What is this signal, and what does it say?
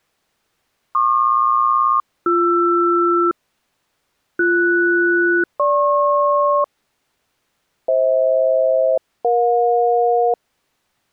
Aircraft SELCAL, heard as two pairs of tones. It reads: PQ-BR BS-GP FH-EJ